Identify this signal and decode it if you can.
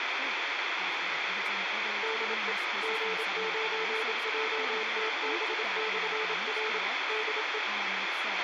Morse code, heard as a keyed tone, machine-sent, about 27 wpm, 440 Hz, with radio hiss, a squelch burst at the end and speech in English. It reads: DE G9JTB/R DE